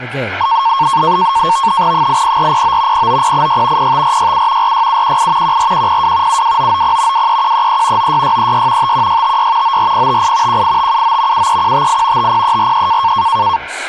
NAVTEX (SITOR-B), 100 baud, 170 Hz shift, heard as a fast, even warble, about 1000 Hz centre, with speech in English. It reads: 80409 09086 05467 46718 14102 72990 23133 96636 51656 94058 18579 73158 50343